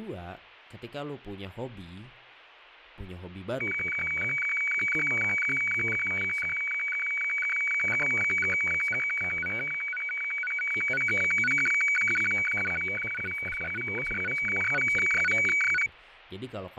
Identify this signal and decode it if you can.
Weather fax (radiofax), 120 lines a minute, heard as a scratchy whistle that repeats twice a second, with radio static, fading and speech in Indonesian.